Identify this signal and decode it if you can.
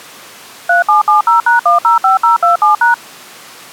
DTMF, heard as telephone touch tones, dialled by machine, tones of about 130 ms. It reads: 3770#105027#